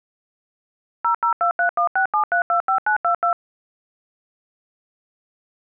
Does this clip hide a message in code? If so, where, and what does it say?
Yes: DTMF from 1.0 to 3.3 s, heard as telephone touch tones, dialled by machine, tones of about 100 ms. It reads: 0023167325922